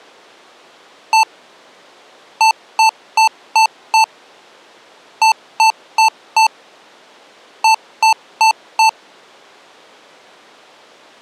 Beep code, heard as beeps from a small speaker, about 880 Hz. 1-5-4-4.